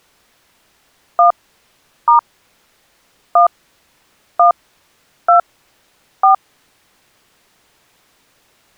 DTMF, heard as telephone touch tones, dialled by hand, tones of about 120 ms. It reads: 1 * 1 1 2 4